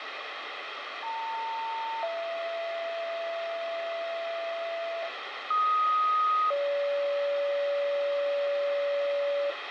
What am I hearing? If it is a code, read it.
Two-tone page, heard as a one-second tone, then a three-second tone, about 900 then 670 Hz, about 1250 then 570 Hz, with radio hiss and room echo.